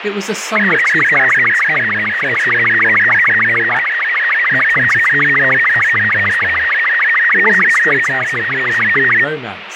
SSTV (slow-scan television), Robot 36, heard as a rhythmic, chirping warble, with radio static and speech in English.